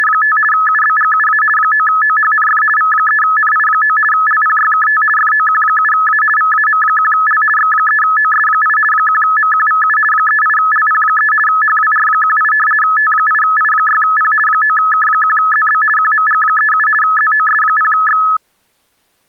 RTTY (50 baud, 450 Hz shift), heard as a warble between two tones, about 1500 Hz centre. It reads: … UBGUA 9OHNF V3NI9 LPYKT FOQ7A VAM1L X3OS8 1MQVU 38LP3 HWR18 T8I6P 9K1ZB QMG37 ZOS0X